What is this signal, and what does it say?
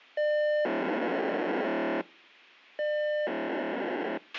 POCSAG pager data (1200 baud), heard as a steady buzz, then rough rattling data, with a squelch burst at the end.